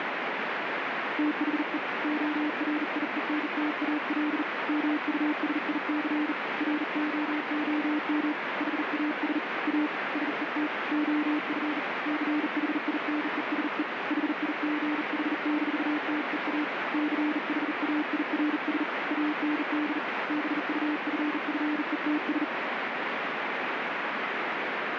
Morse code, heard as a keyed tone, hand-sent with a bug key, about 39 wpm, 300 Hz, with heavy radio static. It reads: THE ORIENTAL MUSIC ROOM HAS A SET OF CHINESE HIGH-TEA CHAIRS AND BUFFETS